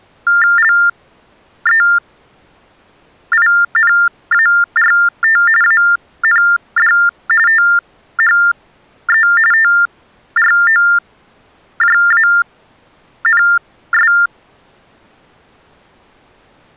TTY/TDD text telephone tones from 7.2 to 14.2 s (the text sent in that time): THE TROJANS